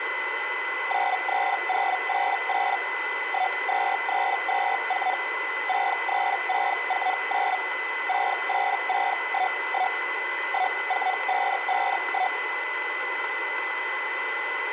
Hellschreiber (Feld-Hell, 122.5 baud), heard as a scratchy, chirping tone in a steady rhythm, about 740 Hz, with radio static and a steady whistle near 2010 Hz. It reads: 93088 12324 63649 68611 14551